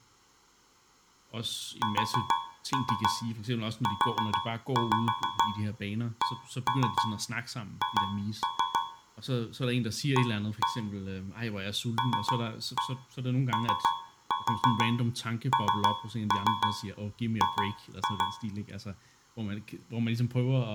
Tap code, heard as taps on a metal pipe, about 6 knocks a second, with speech in Danish. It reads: SUCH A LONG